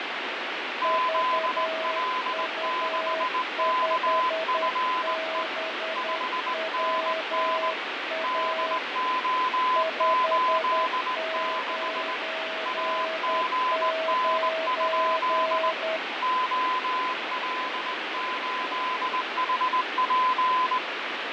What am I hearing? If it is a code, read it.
Morse code, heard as two keyed tones, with heavy radio static and fading. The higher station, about 19 wpm, 1020 Hz: ZL6KFE 5NN DO86 AGN? OL8HP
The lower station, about 10 wpm, 640 Hz: VU5BWA 599